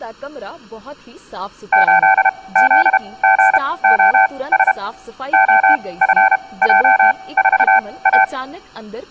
Morse code, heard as a keyed tone, machine-sent, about 32 wpm, spaced as for 21 wpm, 770 Hz, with room echo and speech in Punjabi. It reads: 8ZGOS OFJ4A